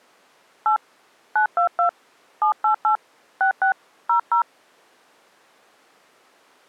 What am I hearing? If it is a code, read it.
DTMF, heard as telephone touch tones, dialled by hand, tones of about 100 ms. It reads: 8 922 788 66 00